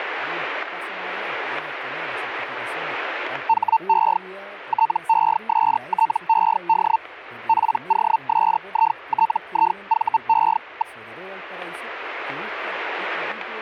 Hellschreiber (Feld-Hell, 122.5 baud), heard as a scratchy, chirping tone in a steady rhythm, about 900 Hz. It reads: HE TESTED POSITIVE.